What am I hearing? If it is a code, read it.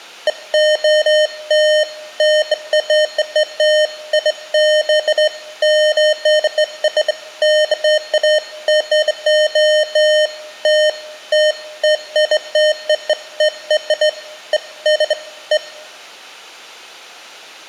Beeps of irregular length. There is no code.